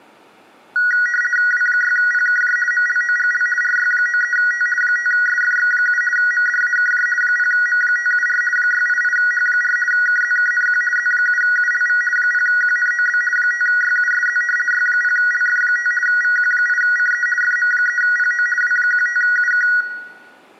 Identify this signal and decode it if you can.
RTTY (50 baud, 450 Hz shift), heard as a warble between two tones, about 1700 Hz centre, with room echo. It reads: W6PKJ MLOGL RY93T 5SFX7 MDAKJ 0M574 688H4 KZKNQ Z7ULV 0QNOB 5YUSZ Y0LF5 VQ8CE FM3PO W15UK